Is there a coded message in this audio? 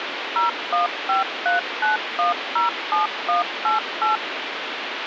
Yes: DTMF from 0.4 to 4.2 s, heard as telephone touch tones, dialled by machine, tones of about 140 ms, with phone line noise. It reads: 01539107188